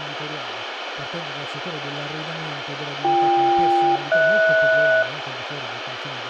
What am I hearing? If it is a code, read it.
Aircraft SELCAL, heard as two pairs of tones, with radio hiss, room echo and speech in Italian. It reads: BK-HS